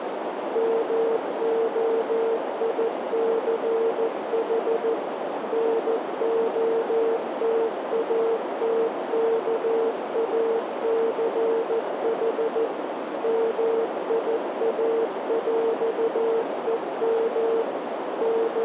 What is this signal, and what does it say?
Morse code (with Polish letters), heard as a keyed tone, machine-sent, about 14 wpm, 450 Hz, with heavy radio static and a narrow filter. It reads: MOICH NOTATKACH MIAŁEM …